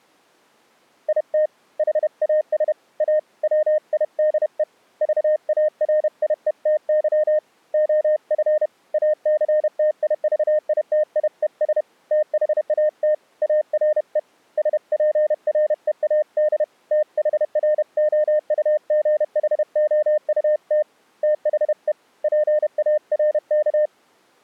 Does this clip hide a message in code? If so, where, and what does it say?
Yes: Morse code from 1.0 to 23.9 s, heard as a keyed tone, hand-sent with a paddle, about 31 wpm, 610 Hz. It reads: IT HAS A WIDE VARIETY OF ACTIVITIES THAT ARE SPREAD THROUGHOUT THE PARK